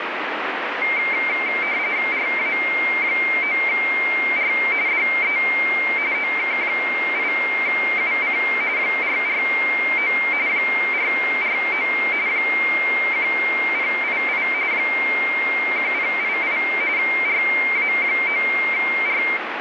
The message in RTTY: RA9R DE OK8UC 449 449 1088 1088 RA9R

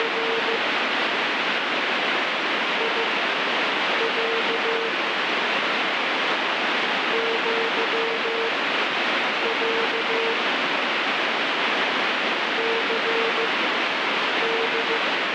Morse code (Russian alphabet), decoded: … ИЯ ЪЯ ЦД

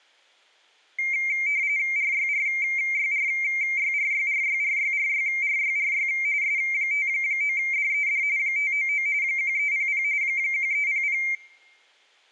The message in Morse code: none

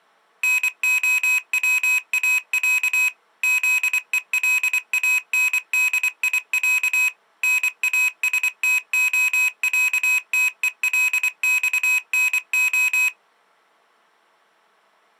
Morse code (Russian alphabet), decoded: НОВАЯ ЗЕЛАНДИЯ НАСТОЯТЕЛЬНО

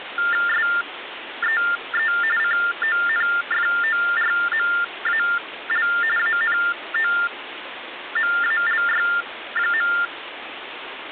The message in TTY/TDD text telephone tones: SEE CONFORMAL ANOMALY.

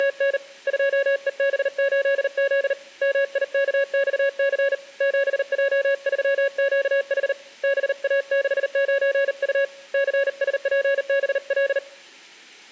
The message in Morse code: … 2EB8Z MIKXC 7J3QH BA69U CSPBL

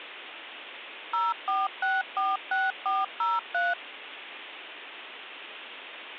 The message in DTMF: 04646403

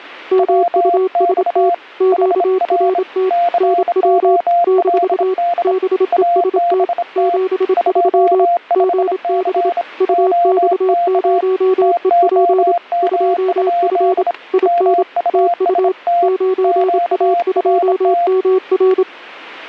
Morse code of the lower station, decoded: MUST QRT NW - BEST 73 GB UX0EP 2F IN TU 9A2MR

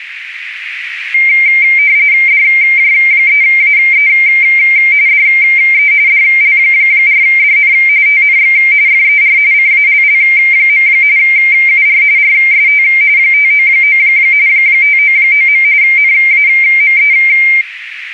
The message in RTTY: DJ3AE DE DL4DN TNX FER CALL. UR RST 599 599. NAME

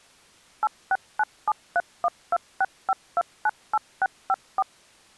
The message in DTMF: 869731265298654

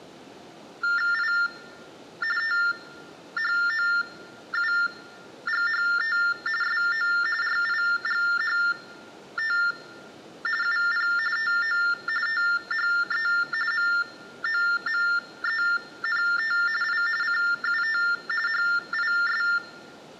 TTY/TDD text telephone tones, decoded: I THOUGHT SO RIGHT UP TO THE MOMENT I CUT HIS

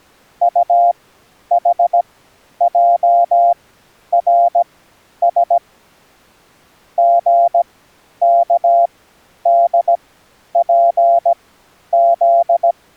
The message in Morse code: UHJRS GKDPZ

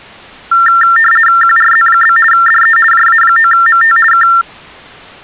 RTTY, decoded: QRZ? DE JA9MT K

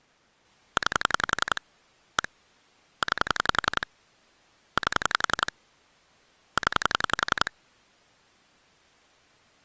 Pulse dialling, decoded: 9 1 9 8 0

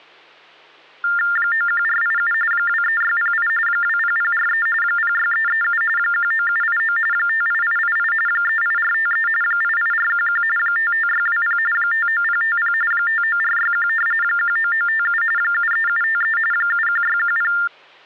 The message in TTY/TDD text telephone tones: 91487 23608 20043 06337 19789 58888 38453 88411 55620 59050 59461 19957 73753 71610

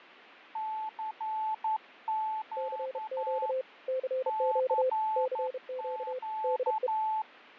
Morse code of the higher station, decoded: CQ CQ

